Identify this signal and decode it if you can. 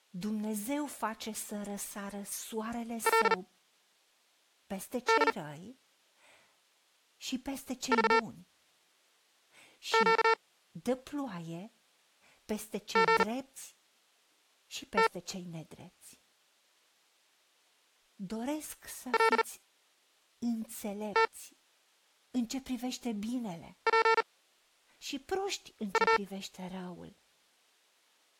Morse code (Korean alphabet), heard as electronic beeps, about 39 wpm, spaced as for 5 wpm, 450 Hz, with speech in Romanian. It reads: 그래서 거지